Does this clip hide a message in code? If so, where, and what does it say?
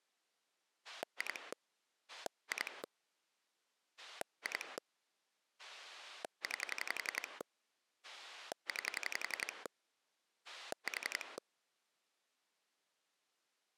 Yes: pulse dialling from 0.8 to 11.4 s, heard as a rotary dial, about 11 pulses a second. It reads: 2 2 2 9 9 4